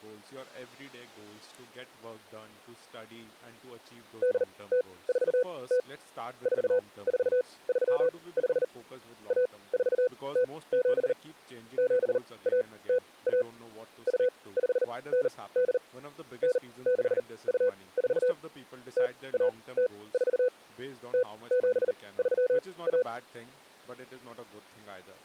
Morse code (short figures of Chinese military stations), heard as a keyed tone, machine-sent, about 39 wpm, spaced as for 22 wpm, 500 Hz, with speech in English. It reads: 8040 4435 1407 7101 2598 9624 0104 0731